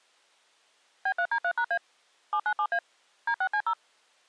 DTMF, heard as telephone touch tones, dialled by machine, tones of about 70 ms. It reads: B3D3#A 797A D6C0